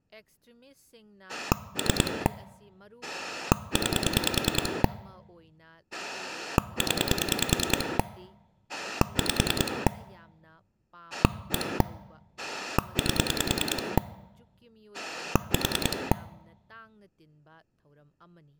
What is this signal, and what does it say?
Pulse dialling, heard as a rotary dial, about 10 pulses a second, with speech in Manipuri. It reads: 3 9 0 5 1 8 4